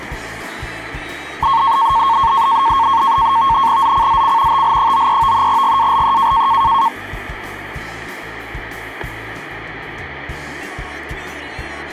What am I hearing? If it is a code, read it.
NAVTEX (SITOR-B), 100 baud, 170 Hz shift, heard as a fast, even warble, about 1000 Hz centre. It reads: ZCZC TL93 GALE